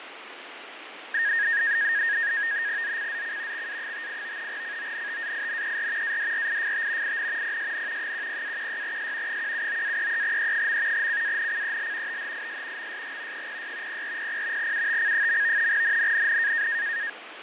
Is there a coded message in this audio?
Yes: NAVTEX (SITOR-B), 100 baud, 170 Hz shift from 1.1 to 17.1 s, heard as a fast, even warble, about 1750 Hz centre, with radio static and fading. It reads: ZCZC XA58 CONTAINER ADRIFT IN PSN 10-16S 179-33E. CANCEL THIS MSG 06 0400 UTC. NNNN